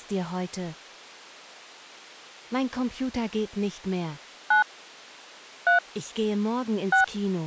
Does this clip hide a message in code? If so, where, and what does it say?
Yes: DTMF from 4.5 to 7.0 s, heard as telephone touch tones, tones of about 120 ms. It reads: 9 3 6